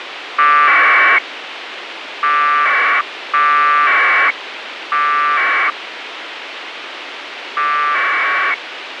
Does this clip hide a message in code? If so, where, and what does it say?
Yes: packet radio (AX.25, as in APRS), 1200 baud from 0.4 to 8.5 s, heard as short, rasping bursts, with radio hiss.